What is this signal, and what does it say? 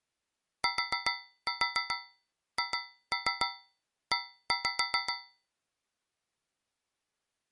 Tap code, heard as taps on a metal pipe, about 7 knocks a second. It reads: THE